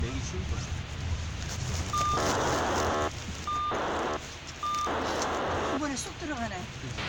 POCSAG pager data (2400 baud), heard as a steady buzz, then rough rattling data, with radio hiss, a squelch burst at the end and the noise inside a car.